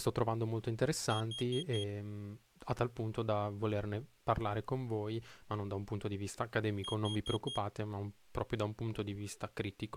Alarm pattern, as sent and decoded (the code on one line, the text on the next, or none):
4 beeps and a pause
temporal four